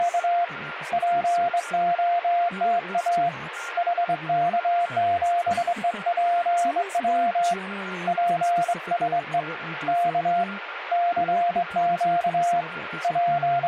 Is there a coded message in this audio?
Yes: Morse code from 0.0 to 13.7 s, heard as a keyed tone, hand-sent with a straight key, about 23 wpm, 700 Hz, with radio static, a weaker station near 1400 Hz and speech in English. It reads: … POTA HK7EPW PSE K CQ …